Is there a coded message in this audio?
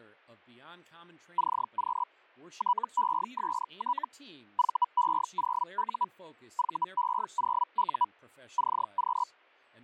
Yes: Hellschreiber (Feld-Hell, 122.5 baud) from 1.4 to 9.3 s, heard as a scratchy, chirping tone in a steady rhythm, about 980 Hz, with speech in English. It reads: CQ TEST VE0U VE0U CQ